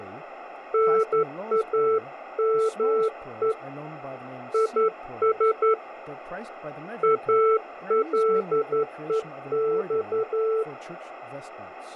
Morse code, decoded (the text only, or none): NAME IS ALEX